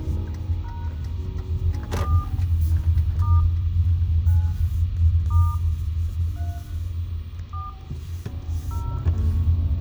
DTMF, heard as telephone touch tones, dialled by hand, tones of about 220 ms, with radio hiss, a squelch burst at the end, room echo and the noise inside a car. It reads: # 4 * 9 * 3 4 0